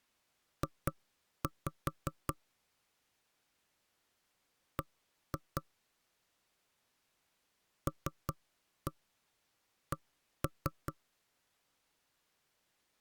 Tap code, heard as knocks on wood, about 4 knocks a second. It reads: J B LC